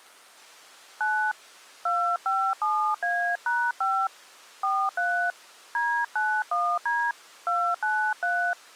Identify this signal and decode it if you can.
DTMF, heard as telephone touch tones, dialled by hand, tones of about 280 ms. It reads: 9 257A#5 43 D91D 293